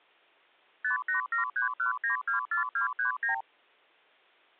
Multi-frequency trunk signalling (R2, with the far end's replies), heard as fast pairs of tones, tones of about 120 ms. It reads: 58731924239